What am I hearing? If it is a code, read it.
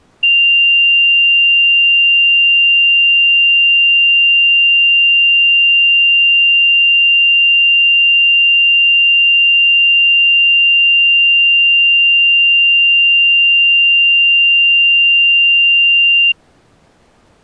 A steady tone. There is no code.